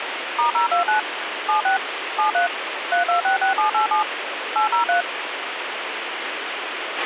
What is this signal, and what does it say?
DTMF, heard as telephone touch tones, dialled by machine, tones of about 120 ms, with radio hiss and a squelch burst at the end. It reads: *029 76 73 3266787 803